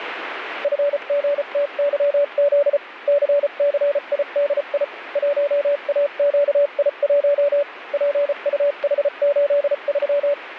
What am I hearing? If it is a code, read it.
Morse code, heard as a keyed tone, machine-sent, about 34 wpm, spaced as for 31 wpm, 570 Hz, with radio static. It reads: FGTYZ CCIDI 1AQI1 PUH83